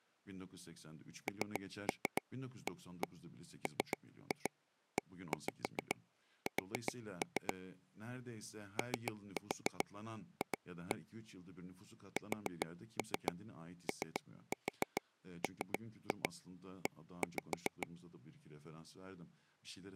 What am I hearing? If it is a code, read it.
Tap code, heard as taps on a table, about 7 knocks a second, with speech in Turkish. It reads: NAMES OF SOME